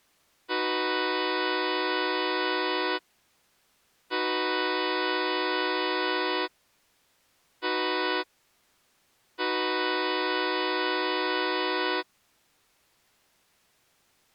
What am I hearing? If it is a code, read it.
Train horn signal, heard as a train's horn. 2 long, 1 short, 1 long. On North American railways: approaching a public crossing.